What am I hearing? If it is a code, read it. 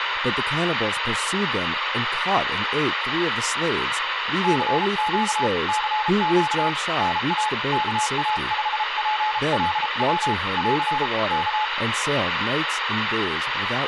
Morse code, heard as a keyed tone, hand-sent with a paddle, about 33 wpm, 860 Hz, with radio static and speech in English. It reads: CQ CQ NA KA5PLW <AR> K